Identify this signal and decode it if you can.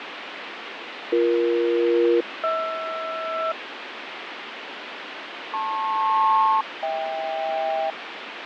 Aircraft SELCAL, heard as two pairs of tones, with radio static and fading. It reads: BE-HR LP-HK